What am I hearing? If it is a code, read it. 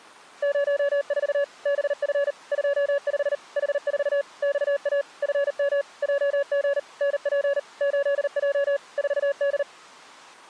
Morse code, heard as a keyed tone, machine-sent, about 39 wpm, 560 Hz. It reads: 04 BF 25 H4 XA FM JG NP 8J 4D